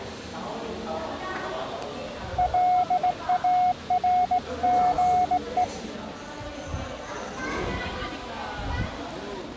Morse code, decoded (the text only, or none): LARGE